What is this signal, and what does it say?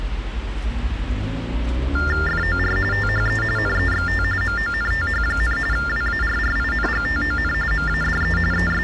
TTY/TDD text telephone tones (45.45 baud Baudot), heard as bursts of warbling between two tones, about 400 Hz shift, 1600 Hz centre, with street noise. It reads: FOR THE NEXT MONTH, WARRINGTON MADE …